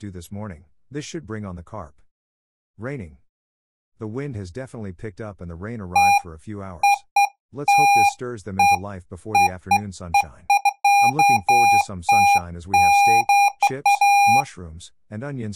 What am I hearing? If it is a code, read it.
Beeps of irregular length, with speech in English. There is no code.